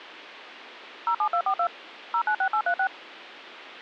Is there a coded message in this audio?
Yes: DTMF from 1.1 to 2.9 s, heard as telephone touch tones, dialled by machine, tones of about 80 ms. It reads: 07242 096836